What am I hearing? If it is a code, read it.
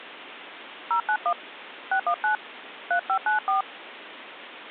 DTMF, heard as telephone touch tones, dialled by hand, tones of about 100 ms, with phone line noise. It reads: 091 619 3594